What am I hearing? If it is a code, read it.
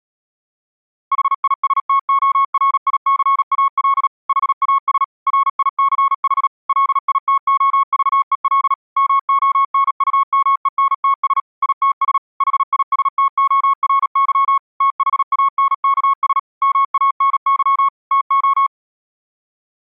Morse code, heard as a keyed tone, machine-sent, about 37 wpm, 1100 Hz. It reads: HISTORICAL HAS RICH LITOVEL MONUMENTS ITS HISTORY THANKS MANY TO